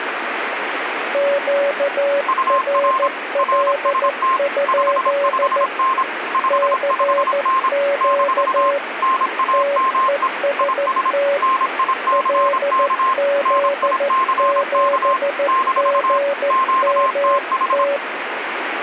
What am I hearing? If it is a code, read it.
Morse code, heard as two keyed tones, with radio static. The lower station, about 14 wpm, 560 Hz: QRL? CQ TEST LZ7GMT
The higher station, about 26 wpm, 1050 Hz: UR RST 55N 55N - NAME IS NICK NICK - QTH